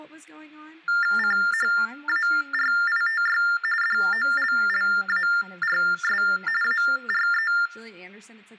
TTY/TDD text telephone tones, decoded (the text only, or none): CHARITY DOLLARS ARE